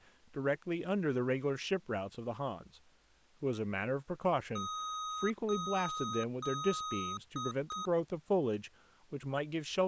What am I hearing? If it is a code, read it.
Beep code, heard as beeps from a small speaker, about 1260 Hz, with speech in English. 3 long, 2 short.